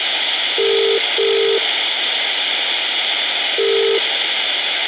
Telephone call progress tone (as in the UK, Ireland, Australia and similar networks), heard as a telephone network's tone, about 400, 450 Hz, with phone line noise and room echo. Ringback tone.